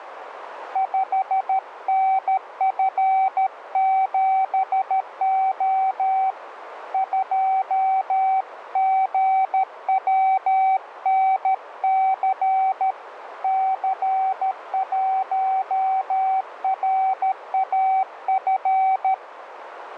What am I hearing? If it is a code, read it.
Morse code, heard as a keyed tone, hand-sent with a paddle, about 13 wpm, 760 Hz, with radio static and a narrow filter. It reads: 5NF7O 2GWNC C1RAF